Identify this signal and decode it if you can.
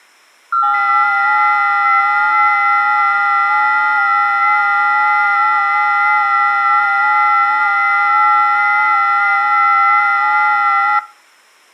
FT8 (several signals at once), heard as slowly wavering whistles, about 6.25 baud.